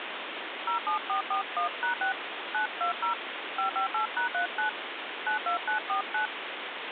DTMF, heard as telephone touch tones, dialled by hand, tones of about 110 ms, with phone line noise. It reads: 07441#6 920 558#39 92949